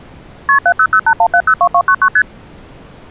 Multi-frequency trunk signalling (R1, as on North American trunks), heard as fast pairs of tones, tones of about 70 ms. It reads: KP 70081702299 ST